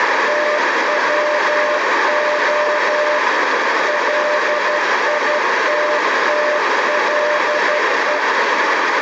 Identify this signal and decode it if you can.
Morse code, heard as a keyed tone, machine-sent, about 12 wpm, 600 Hz, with heavy radio static and a narrow filter. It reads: TWO LITTLE